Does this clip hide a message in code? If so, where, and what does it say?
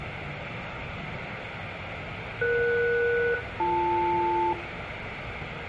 Yes: aircraft SELCAL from 2.4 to 4.5 s, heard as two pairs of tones, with radio hiss, room echo and the noise inside a subway train. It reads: ES-BL